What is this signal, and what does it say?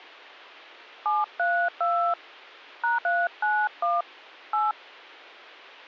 DTMF, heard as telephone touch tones, dialled by hand, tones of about 250 ms. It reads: 732 #391 8